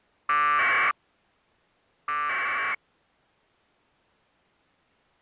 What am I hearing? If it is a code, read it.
Packet radio (AX.25, as in APRS), 1200 baud, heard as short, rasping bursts.